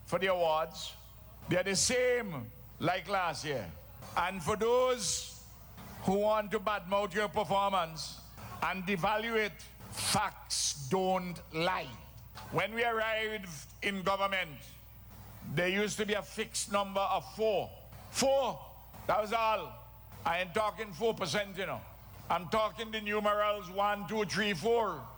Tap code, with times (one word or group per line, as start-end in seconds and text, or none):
none